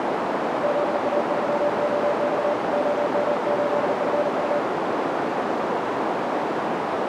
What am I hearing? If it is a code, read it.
Morse code, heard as a keyed tone, hand-sent with a paddle, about 39 wpm, 590 Hz, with heavy radio static and a narrow filter. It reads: ZA3OX OM8FU